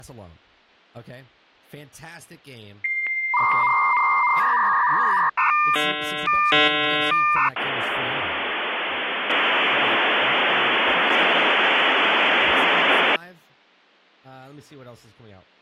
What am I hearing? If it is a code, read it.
Dial-up modem handshake (V.34 or later), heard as a whistle, warbles, then hiss, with speech in English.